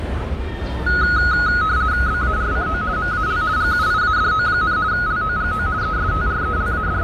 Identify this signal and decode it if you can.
RTTY (50 baud, 170 Hz shift), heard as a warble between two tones, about 1360 Hz centre, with fading and the noise of a residential street. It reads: BARCO MAL GUIADO, LOGO …